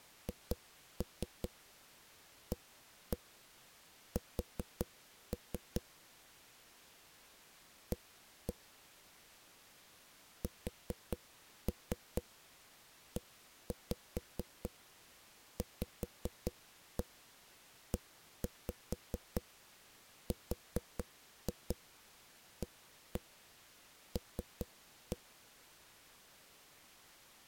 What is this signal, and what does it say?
Tap code, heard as knocks on a wall, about 4 knocks a second. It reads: HAS A SEVERAL